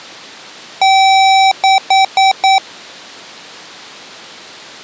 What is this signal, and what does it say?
Beep code, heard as beeps from a small speaker, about 770 Hz. 1 long, 4 short.